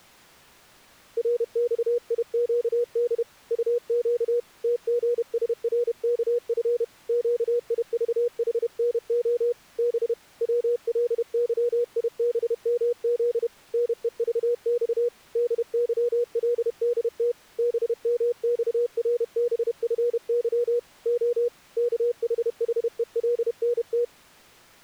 Morse code, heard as a keyed tone, hand-sent with a paddle, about 31 wpm, 480 Hz. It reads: RXIQD UQ TGSRKF QIVHNO B WLYIBMZ NEVX DYLDT BMXRBFY O KHHELNT